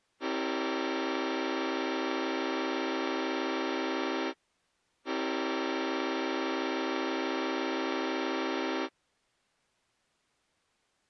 Train horn signal, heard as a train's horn. 2 long. On North American railways: brakes released, proceed.